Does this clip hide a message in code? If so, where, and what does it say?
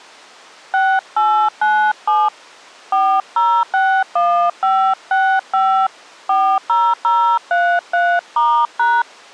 Yes: DTMF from 0.7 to 9.0 s, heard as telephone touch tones, dialled by hand, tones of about 290 ms. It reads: 6897 4061565 40033*#